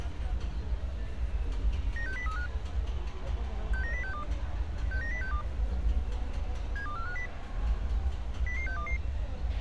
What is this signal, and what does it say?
Five-tone selective call (CCIR), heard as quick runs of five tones, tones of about 100 ms, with a squelch burst at the end and street noise. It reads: 96035 69062 69062 72450 00622